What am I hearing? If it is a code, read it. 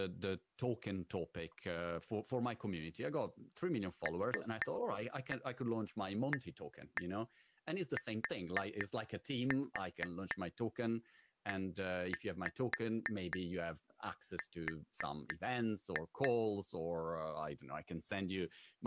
Tap code, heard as taps on glass, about 4 knocks a second, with speech in English. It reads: LATER